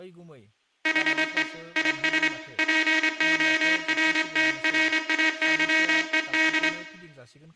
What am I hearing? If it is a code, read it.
Morse code, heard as a buzzer, hand-sent with a straight key, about 25 wpm, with room echo and speech in Bodo. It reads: HE IS PORTRAYED